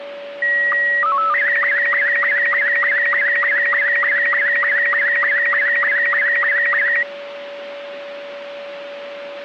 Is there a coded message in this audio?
Yes: SSTV (slow-scan television), Robot 72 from 0.4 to 7.0 s, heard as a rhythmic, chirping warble, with radio static and a steady whistle near 570 Hz.